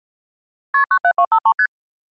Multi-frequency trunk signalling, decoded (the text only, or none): KP 97253 ST